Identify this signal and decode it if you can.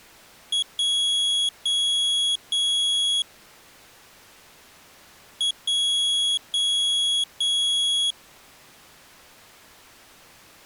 Beep code, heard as a piezo beeper, played twice, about 3350 Hz. 1 short, 3 long.